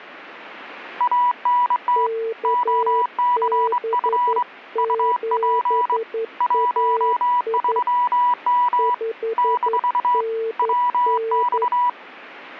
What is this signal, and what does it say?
Morse code, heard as two keyed tones. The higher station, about 23 wpm, 980 Hz: ANT OCF UP 13M - WX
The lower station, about 11 wpm, 450 Hz: KB7AI 5NN